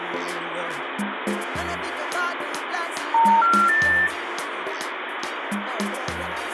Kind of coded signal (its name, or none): telephone call progress tone